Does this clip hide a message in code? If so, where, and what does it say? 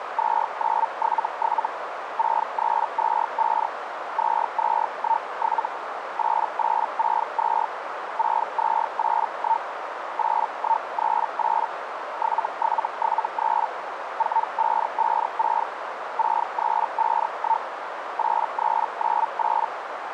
Yes: Hellschreiber (Feld-Hell, 122.5 baud) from 0.2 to 19.7 s, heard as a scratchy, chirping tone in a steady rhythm, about 900 Hz, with radio static and a narrow filter. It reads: 2977 6325 2217 8862 6281 8138 7773 4556 6351 8398